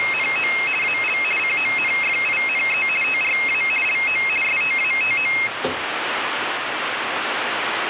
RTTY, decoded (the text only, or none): … AL CONFINE TRA LO STATO